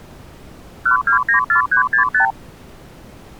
Multi-frequency trunk signalling (R2, with the far end's replies), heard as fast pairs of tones, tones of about 110 ms. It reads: 1294365